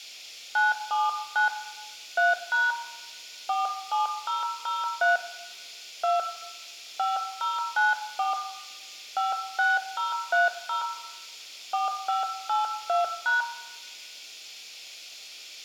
DTMF, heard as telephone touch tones, dialled by hand, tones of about 160 ms, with room echo. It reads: 979 3# 47003 2 5094 56030 4582#